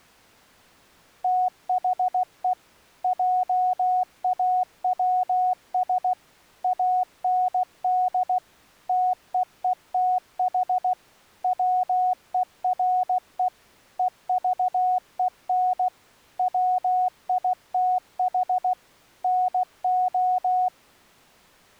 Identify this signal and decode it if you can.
Morse code, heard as a keyed tone, machine-sent, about 16 wpm, 730 Hz. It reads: THE JAWS AND TEETH WERE EVEN WITH NO